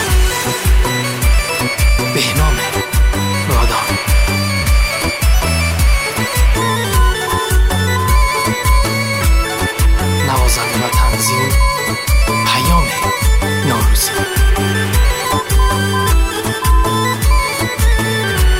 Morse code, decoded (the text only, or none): SN SN SN